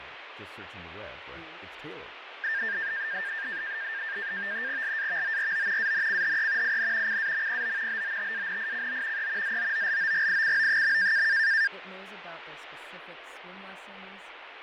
NAVTEX (SITOR-B), 100 baud, 170 Hz shift, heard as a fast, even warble, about 1700 Hz centre, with radio static and fading. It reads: LAVORO ANCHE IN CAMPO BOTANICO E ZOOLOGICO.